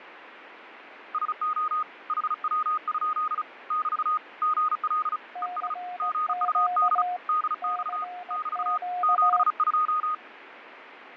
Morse code, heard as two keyed tones, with radio static and fading. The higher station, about 35 wpm, 1240 Hz: SO HW? <BT> GL ES GUD DX <BT> 72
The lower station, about 18 wpm, 720 Hz: CQ CQ